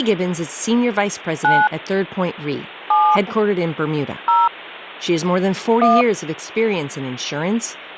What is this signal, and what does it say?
DTMF, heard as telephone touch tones, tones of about 220 ms, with hum and speech in English. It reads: 9 7 0 1